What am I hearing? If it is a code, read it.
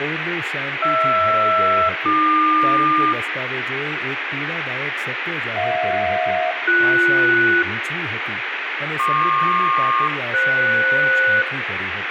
Aircraft SELCAL, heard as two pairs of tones, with radio static and speech in Gujarati. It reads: HR-AQ HJ-BS PQ-FS